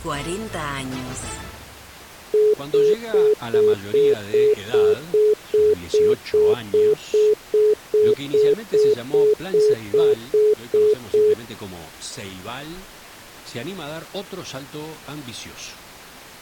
Telephone call progress tone (single-tone plan, as in most of Europe), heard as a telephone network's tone, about 420 Hz, 0.2 s on and 0.2 s off. Congestion tone.